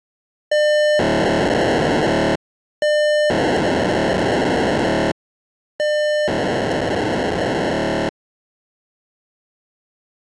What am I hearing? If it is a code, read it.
POCSAG pager data (1200 baud), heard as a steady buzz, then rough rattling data.